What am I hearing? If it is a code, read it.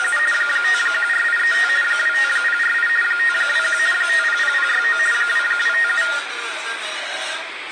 RTTY (50 baud, 450 Hz shift), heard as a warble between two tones, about 1650 Hz centre, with radio static and the noise of a crowd indoors. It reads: … 514835 25048 521 500069 2257